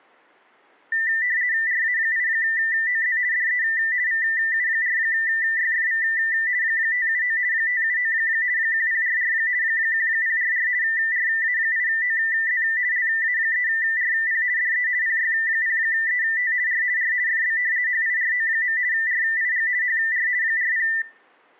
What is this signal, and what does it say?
RTTY (50 baud, 170 Hz shift), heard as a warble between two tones, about 1900 Hz centre, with room echo. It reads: RA8OZ DE VU4YFV 579 579 1044 1044 RA8OZ LA3RP DE PY0ET R R FB HIRO. RIG HR 40